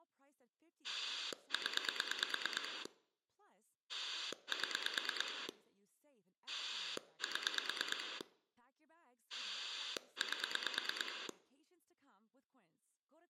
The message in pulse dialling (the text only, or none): 0 7 7 8